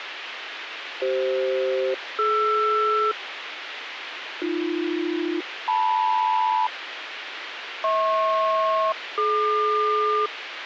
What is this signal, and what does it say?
Aircraft SELCAL, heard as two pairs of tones, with radio hiss. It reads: CF-DR AB-LM HP-DQ